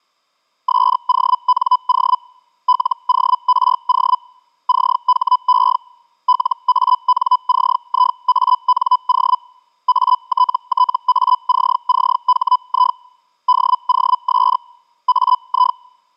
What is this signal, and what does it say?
Hellschreiber (Feld-Hell, 122.5 baud), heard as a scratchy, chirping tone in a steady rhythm, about 1000 Hz. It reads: SONO LORO CHE LANCIANO ATTACCHI DOS AI